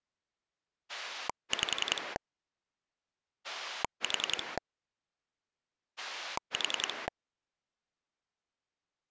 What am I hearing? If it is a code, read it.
Pulse dialling, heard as a rotary dial, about 10 pulses a second. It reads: 5 4 4